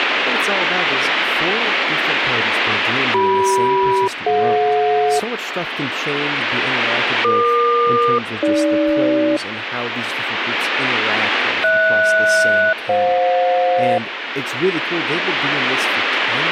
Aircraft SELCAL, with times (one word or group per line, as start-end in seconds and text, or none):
3.1-5.2 CM-DJ
7.2-9.4 EQ-AG
11.6-14.0 HS-FJ